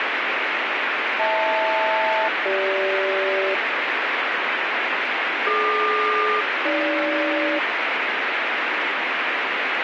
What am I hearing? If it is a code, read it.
Aircraft SELCAL, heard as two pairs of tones, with heavy radio static. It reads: HL-CG DQ-AG